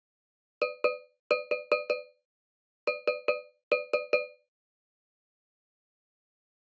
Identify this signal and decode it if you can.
Tap code, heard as taps on a metal pipe, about 5 knocks a second. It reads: IN